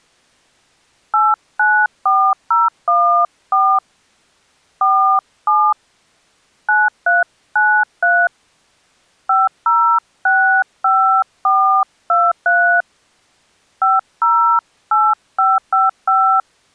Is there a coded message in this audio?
Yes: DTMF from 1.1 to 16.4 s, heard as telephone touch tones, dialled by hand, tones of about 270 ms. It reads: 894014 47 9393 5065423 508555